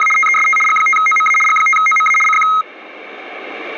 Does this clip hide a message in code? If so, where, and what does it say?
Yes: RTTY (75 baud, 850 Hz shift) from 0.0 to 2.6 s, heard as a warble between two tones, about 1700 Hz centre. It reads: … TEST G5OMA G5OMA CQ